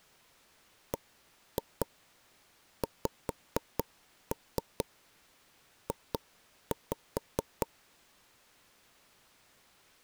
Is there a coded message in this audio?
Yes: tap code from 0.9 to 7.7 s, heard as knocks on wood, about 4 knocks a second. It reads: BXJ